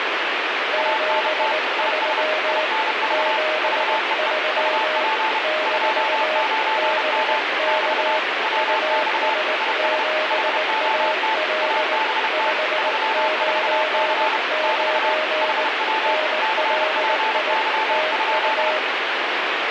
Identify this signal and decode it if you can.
Morse code, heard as two keyed tones, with heavy radio static. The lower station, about 19 wpm, 620 Hz: 73 73 - BK US7AL 599 NLI TU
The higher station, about 31 wpm, 880 Hz: ANT IS INV VEE UP 29M <BT> WX IS HOT ABT 34C <BT> HW CPY?